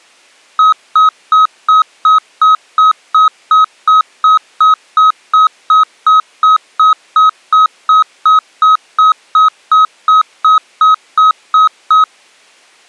Evenly repeated beeps. There is no code.